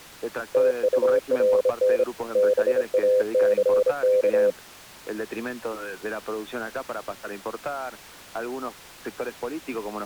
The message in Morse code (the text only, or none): TURN BACK